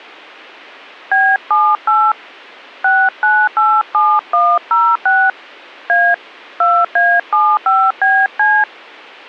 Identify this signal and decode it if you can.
DTMF, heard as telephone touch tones, dialled by hand, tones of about 240 ms. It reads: B78 6987106 A 2A75BC